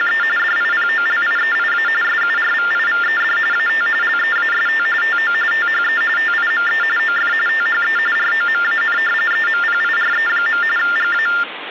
TTY/TDD text telephone tones (45.45 baud Baudot), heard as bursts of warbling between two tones, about 400 Hz shift, 1600 Hz centre, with phone line noise. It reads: … DIPOLIEIA SURVIVED AT LEAST TO THE TIME OF THE ROMAN EMPIRE. GA